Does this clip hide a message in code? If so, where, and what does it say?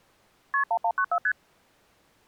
Yes: multi-frequency trunk signalling (R1, as on North American trunks) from 0.5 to 1.3 s, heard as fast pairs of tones, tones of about 70 ms. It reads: KP 1194 ST